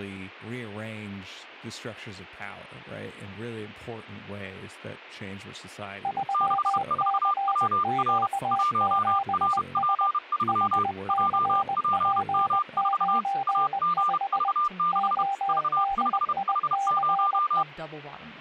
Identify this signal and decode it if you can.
Morse code, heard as two keyed tones, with speech in English. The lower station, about 20 wpm, 790 Hz: 3CQ7S HCP95 ODICE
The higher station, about 31 wpm, 1200 Hz: 64WR 1RP3 JPM4 AGV6 V5H0